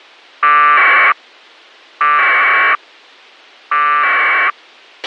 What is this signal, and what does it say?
Packet radio (AX.25, as in APRS), 1200 baud, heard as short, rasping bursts, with a squelch burst at the end.